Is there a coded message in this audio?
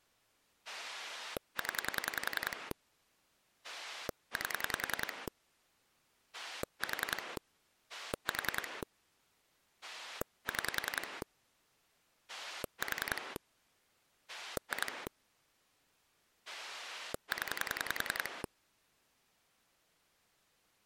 Yes: pulse dialling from 0.7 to 18.5 s, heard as a rotary dial, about 10 pulses a second. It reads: 0 8 4 4 6 4 2 0